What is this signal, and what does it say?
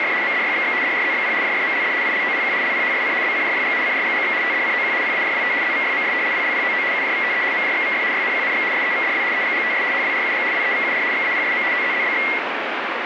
RTTY (75 baud, 170 Hz shift), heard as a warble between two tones, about 2050 Hz centre, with radio static. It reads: … MDYXX DRZXP JFMLD ILOPQ LPHSC BCJYG CRGGX TDCOQ PAJWT ZVYMS PLPOO UJVTE MJXVF YNQNX SEVDW EGGTS HWRUG WEVUR XAPSM OZZBX